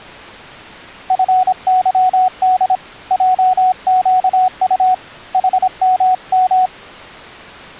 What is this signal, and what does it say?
Morse code, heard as a keyed tone, hand-sent with a paddle, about 26 wpm, 740 Hz. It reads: FYD JQU HMM